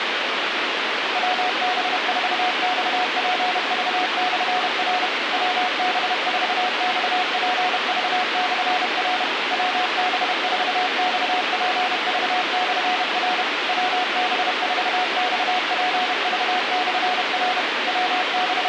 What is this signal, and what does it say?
Morse code, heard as a keyed tone, machine-sent, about 31 wpm, 730 Hz, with radio hiss. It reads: WB4XPV/R WB4XPV/R WB4XPV/R WB4XPV/R …